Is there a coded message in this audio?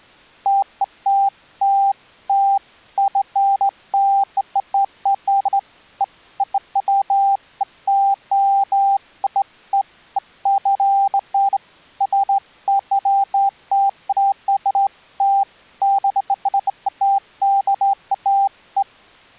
No, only beeps of irregular length.